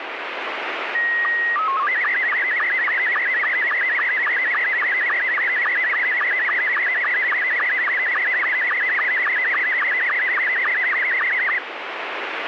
SSTV (slow-scan television), Scottie S2, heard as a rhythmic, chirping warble, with radio static.